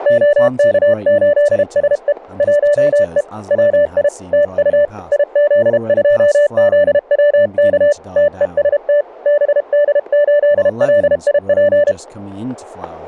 Morse code, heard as a keyed tone, hand-sent with a paddle, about 32 wpm, 580 Hz, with static crashes and speech in English. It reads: OK8SE 1E WI TU IZ2ZWK TEST BD8LIP